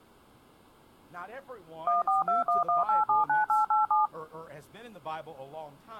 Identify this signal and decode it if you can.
DTMF, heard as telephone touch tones, dialled by machine, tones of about 150 ms. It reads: 14211879887